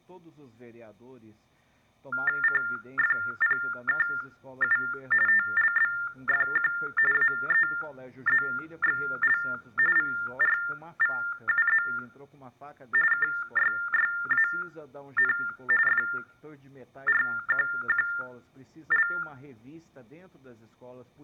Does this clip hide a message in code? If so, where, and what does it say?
Yes: TTY/TDD text telephone tones (45.45 baud Baudot) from 2.1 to 19.2 s, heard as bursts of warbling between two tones, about 400 Hz shift, 1600 Hz centre. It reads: CFPKU TLBFQ AEZXL VRVUZ KYYAN FRQQL